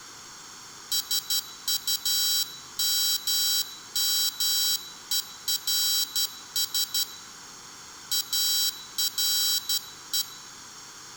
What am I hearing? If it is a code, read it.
Morse code, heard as a high beeper, hand-sent with a straight key, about 12 wpm, 3950 Hz, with room echo. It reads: SUMMERS ARE